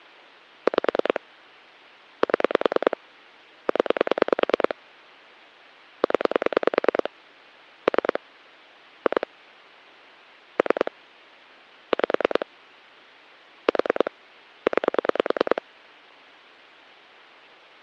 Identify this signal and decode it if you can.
Pulse dialling, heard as clicks on a phone line, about 10 pulses a second. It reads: 5 7 0 0 3 2 3 5 4 9